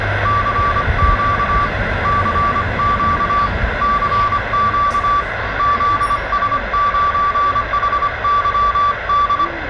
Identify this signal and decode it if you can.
Morse code, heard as a keyed tone, hand-sent with a paddle, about 25 wpm, 1160 Hz, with radio static, room echo and the noise of a residential street. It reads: CQ CQ CQ ZS9HYD